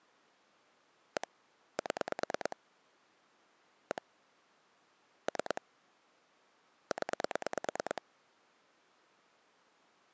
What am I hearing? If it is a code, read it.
Pulse dialling, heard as clicks on a phone line, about 9 pulses a second. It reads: 1 7 1 3 0